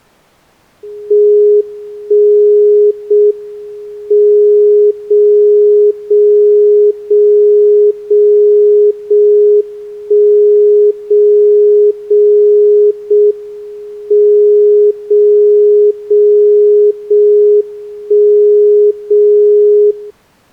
Radio time signal (JJY), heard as a tone whose level steps once a second, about 420 Hz. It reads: 1 0 M 0 0 0 0 0 1 0 0 0 M 0 0 0 1 0 0